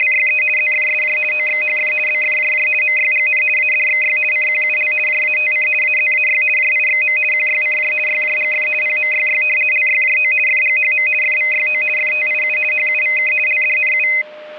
RTTY (50 baud, 450 Hz shift), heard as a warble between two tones, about 2300 Hz centre, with a steady whistle near 610 Hz. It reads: … ZFSJ OXHF BFJJ MYGN ADXY CQUL JATC AZAY JIXM QYCJ YJGF PMYY LYJO FGHM FVYO FTIU HUVK LDNU